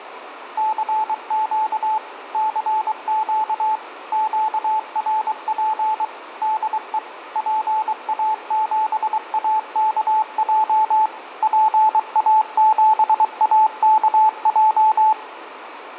Morse code, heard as a keyed tone, machine-sent, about 23 wpm, 870 Hz, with radio static and room echo. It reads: CQ CQ QRP DE PA7AKJ PA7AKJ